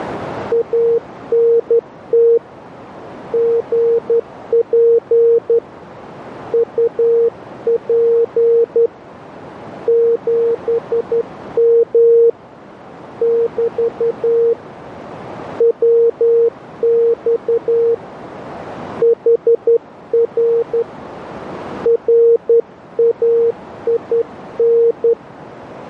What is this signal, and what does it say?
Morse code, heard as a keyed tone, hand-sent with a straight key, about 11 wpm, 460 Hz, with radio static and a narrow filter. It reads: ANT GP UP 7M <BT> WX HR RAIN